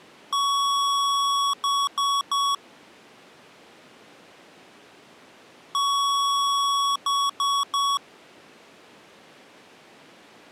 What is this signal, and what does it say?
Beep code, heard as beeps from a small speaker, played twice, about 1120 Hz. 1 long, 3 short. In Award and IBM BIOS tables: video adapter failure; in AMI BIOS tables: memory failure.